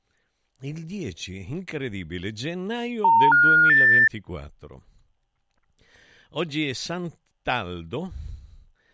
Telephone call progress tone (North American plan), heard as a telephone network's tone, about 910, 1430, 1800 Hz, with speech in Italian. Special information tone.